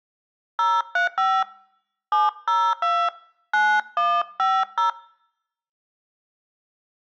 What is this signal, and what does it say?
DTMF, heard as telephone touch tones, dialled by hand, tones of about 190 ms. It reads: 035 702 9150